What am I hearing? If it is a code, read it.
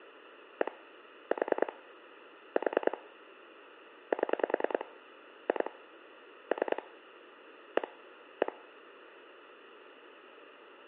Pulse dialling, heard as clicks on a phone line, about 10 pulses a second, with phone line noise. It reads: 1 4 4 7 2 3 1 1